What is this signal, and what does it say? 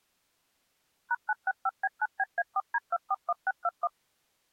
DTMF, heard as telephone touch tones, dialled by machine, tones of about 40 ms. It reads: #965B9BA4D241621